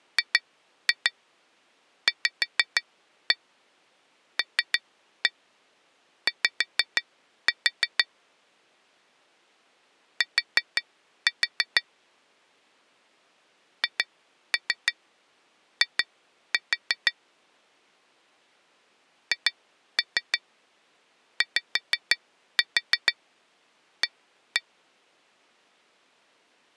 Tap code, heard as taps on glass, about 6 knocks a second. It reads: GVLY T HI HYA